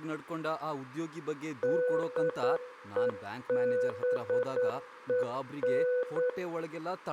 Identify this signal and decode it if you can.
Morse code, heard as a keyed tone, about 9 wpm, 500 Hz, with room echo and speech in Kannada. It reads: DEBEN